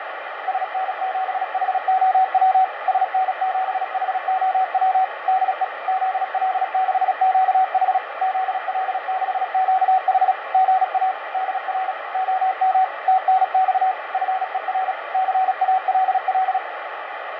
Morse code, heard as a keyed tone, machine-sent, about 36 wpm, 760 Hz, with radio static and fading. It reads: SN7HOW SN7HOW DE ZL6QH ZL6QH GA DR OM TNX FER CALL